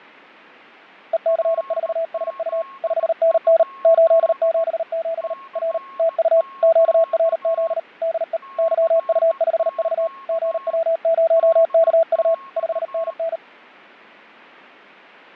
Morse code, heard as a keyed tone, machine-sent, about 38 wpm, 660 Hz, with fading and a weaker station near 1090 Hz. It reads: EC4SU 5NN 877 R TU QRZ DE YU5V GW0KU 5NN